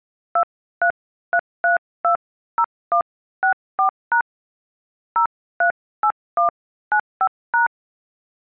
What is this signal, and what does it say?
DTMF, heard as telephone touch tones, dialled by hand, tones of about 100 ms. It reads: 233320164# 038195#